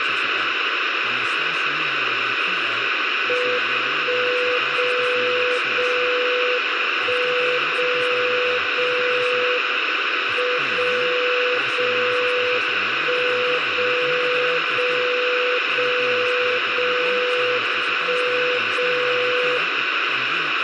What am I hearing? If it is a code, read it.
Radio time signal (WWVB), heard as a tone whose level steps once a second, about 500 Hz, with radio static, room echo and speech in Greek. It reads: 1 0 0 1 0 0 M 0 0 1 0 0 0 0 1 0